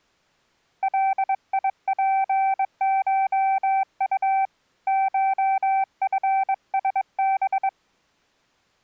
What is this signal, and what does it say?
Morse code (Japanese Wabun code), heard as a keyed tone, hand-sent with a bug key, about 22 wpm, 770 Hz. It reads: ガツコウ コチラハ